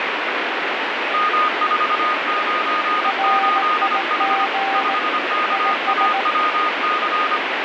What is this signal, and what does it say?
Morse code, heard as two keyed tones, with heavy radio static. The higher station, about 25 wpm, 1230 Hz: M498H 5KAWC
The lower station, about 18 wpm, 780 Hz: RIG IS